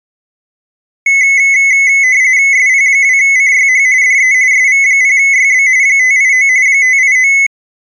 RTTY (45.45 baud, 170 Hz shift), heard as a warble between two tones, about 2100 Hz centre. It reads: SP2CYH DE SV0YB 589 589